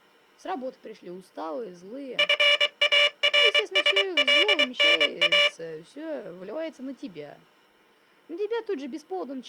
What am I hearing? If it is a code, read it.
Morse code (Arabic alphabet), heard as a buzzer, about 23 wpm. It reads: فارسلنا